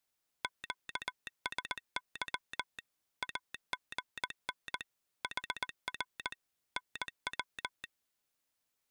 Morse code, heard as a telegraph sounder, machine-sent, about 19 wpm. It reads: QSY AGN HR NW